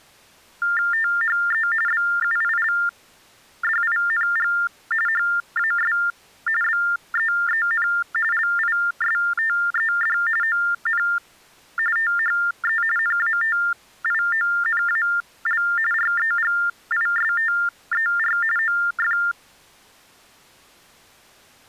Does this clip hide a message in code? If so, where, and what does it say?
Yes: TTY/TDD text telephone tones (45.45 baud Baudot) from 0.6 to 19.3 s, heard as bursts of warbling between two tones, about 400 Hz shift, 1600 Hz centre. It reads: THE BUILDING HAS BEEN LISTED ON THE NATIONAL REGISTER OF